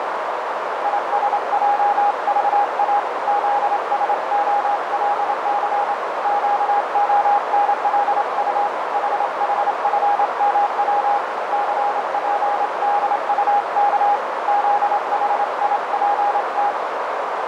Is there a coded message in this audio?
Yes: Morse code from 0.8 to 16.8 s, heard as a keyed tone, hand-sent with a straight key, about 27 wpm, 820 Hz, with heavy radio static and a narrow filter. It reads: ISJVA ZSOLC QONLU HHFMW CPDUK ZHIPT